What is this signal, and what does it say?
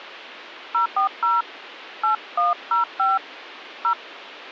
DTMF, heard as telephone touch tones, dialled by hand, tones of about 140 ms. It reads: 040 8105 0